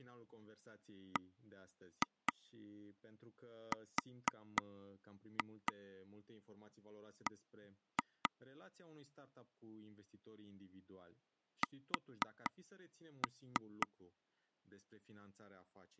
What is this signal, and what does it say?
Tap code, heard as taps on a table, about 4 knocks a second, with speech in Romanian. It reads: BRB S